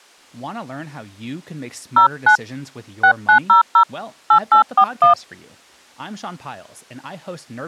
DTMF, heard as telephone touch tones, dialled by hand, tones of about 100 ms, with speech in English. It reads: 09 6900 8841